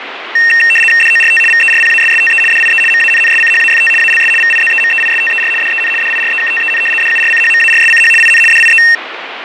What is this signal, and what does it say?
RTTY (75 baud, 850 Hz shift), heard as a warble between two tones, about 2250 Hz centre, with radio static and fading. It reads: DORT VERPASSTE DIE MANNSCHAFT ALS VIZEMEISTER DEN DIREKTEN DURCHMARSCH IN DIE